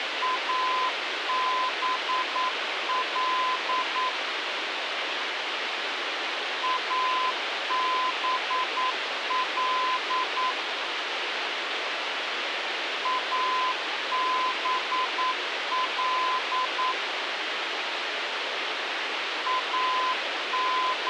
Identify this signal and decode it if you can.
Morse code, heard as a keyed tone, machine-sent, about 9 wpm, 1020 Hz, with radio hiss. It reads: ABL ABL ABL …